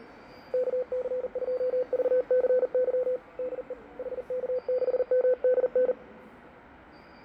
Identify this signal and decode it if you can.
Morse code, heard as a keyed tone, hand-sent with a paddle, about 40 wpm, 510 Hz, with fading and the noise of a subway station. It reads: KC2VCY DE HK6MDN